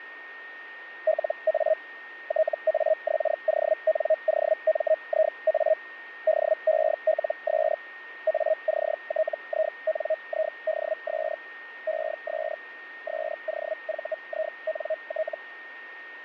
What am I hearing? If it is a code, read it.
Hellschreiber (Feld-Hell, 122.5 baud), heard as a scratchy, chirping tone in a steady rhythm, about 630 Hz, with radio static and a steady whistle near 1850 Hz. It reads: LA TAXONOMIA DELS ACTINIDS ES SOVINT